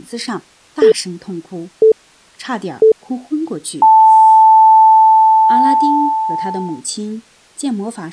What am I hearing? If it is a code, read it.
Radio time signal (three low pips and a long one an octave up, as on NHK), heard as pips, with speech in Chinese.